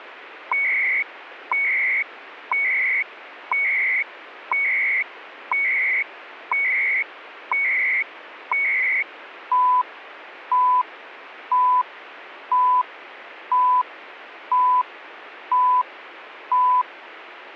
Radio time signal (CHU, Canada), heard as beeps and data bursts, one a second, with radio static.